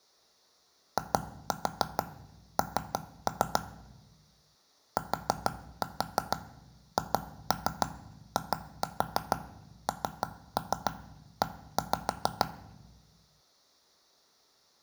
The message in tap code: IN THINE

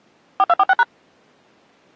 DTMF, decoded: 4246#

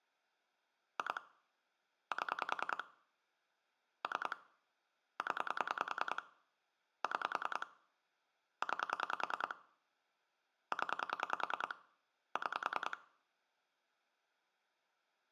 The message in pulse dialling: 2 7 3 0 6 9 0 6

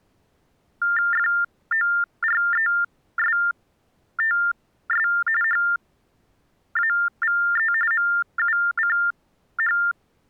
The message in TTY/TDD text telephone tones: FORESTS HAVE MUCH

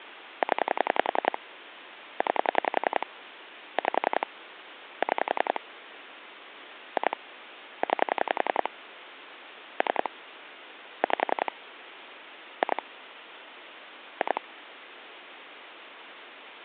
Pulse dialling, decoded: 0 9 5 6 2 9 3 5 2 2

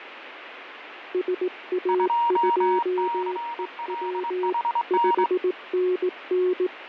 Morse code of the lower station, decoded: SA2EW 5NN

